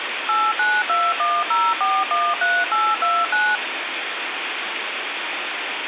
DTMF, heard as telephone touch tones, dialled by machine, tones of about 230 ms, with phone line noise. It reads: 89210413829